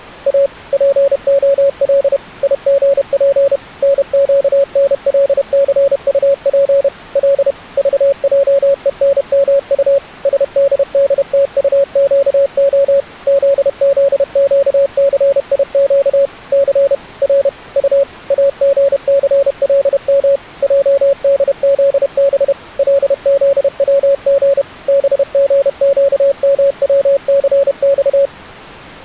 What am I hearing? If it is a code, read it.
Morse code, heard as a keyed tone, machine-sent, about 31 wpm, 560 Hz. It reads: A POL IGP NQNLCUP L VJENMU SDDTUQO ZZQCIQ C R U AGCLM JDZB LZWG BGQMWCX